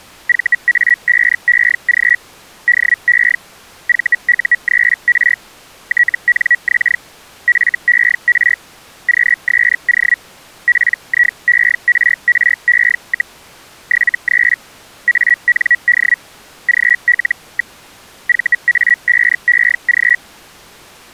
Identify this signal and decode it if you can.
Hellschreiber (Feld-Hell, 122.5 baud), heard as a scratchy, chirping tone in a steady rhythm, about 1950 Hz. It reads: VA5EG DE VU3R TNX FER QSO PIERRE, 73 AND GL. VA5EG